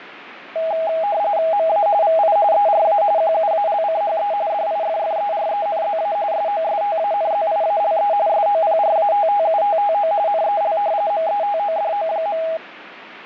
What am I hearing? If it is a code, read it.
RTTY (45.45 baud, 170 Hz shift), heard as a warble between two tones, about 730 Hz centre, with radio static. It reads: MA VI ERA QUALCHE DIFFERENZA SOSTANZIALE SOPRATTUTTO NEL METODO.